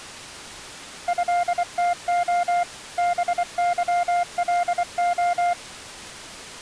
Morse code (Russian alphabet), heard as a keyed tone, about 24 wpm, 700 Hz. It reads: ЭТО БЫЛО